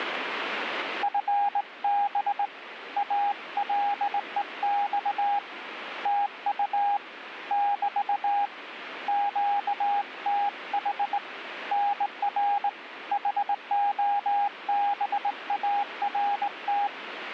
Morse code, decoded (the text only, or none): FB ALEX TU <BT> QTH NR HOBART